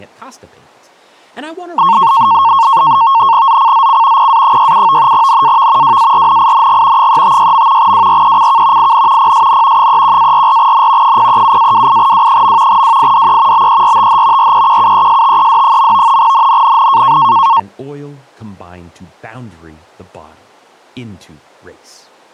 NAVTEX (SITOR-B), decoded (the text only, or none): ZCZC PA67 NAV WARNING 356. WRECK IN PSN 31-44N 037-28W. WIDE BERTH REQUESTED. NNNN